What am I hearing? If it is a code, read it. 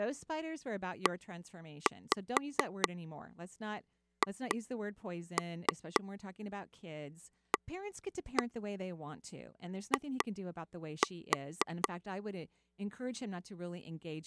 Tap code, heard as taps on a table, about 4 knocks a second, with speech in English. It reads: EHAI